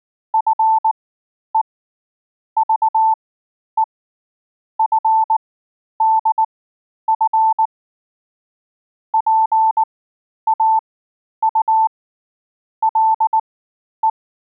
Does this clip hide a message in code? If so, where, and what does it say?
Yes: Morse code (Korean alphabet) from 0.3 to 14.2 s, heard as a keyed tone, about 19 wpm, spaced as for 10 wpm, 880 Hz. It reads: 나라는 죄가